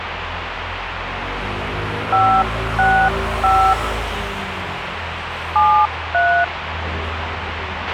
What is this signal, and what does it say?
DTMF, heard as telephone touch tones, dialled by hand, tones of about 300 ms, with radio hiss, a squelch burst at the end and street noise. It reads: 565 73